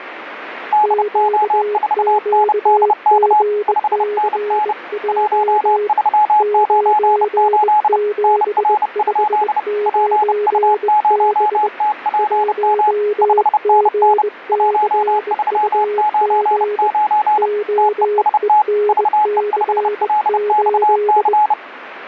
Morse code, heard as two keyed tones, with radio static. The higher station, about 30 wpm, 850 Hz: DO4NDK 5NN 1398 NR? PU0TPM 5NN 1399 TEST VE5LXC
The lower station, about 21 wpm, 420 Hz: QQGCJ 9759B 1GCUG OENC8